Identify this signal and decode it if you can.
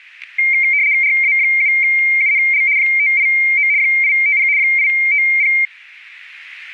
RTTY (75 baud, 170 Hz shift), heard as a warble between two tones, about 2200 Hz centre, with static crashes. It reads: RA7UNL 589 850 850